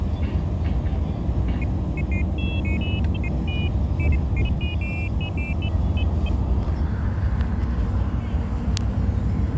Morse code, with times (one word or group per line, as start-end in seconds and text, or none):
none